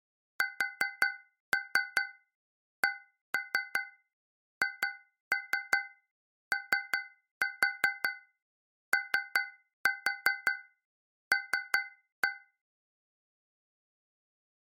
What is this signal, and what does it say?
Tap code, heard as taps on a metal pipe, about 5 knocks a second. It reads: SCHOOL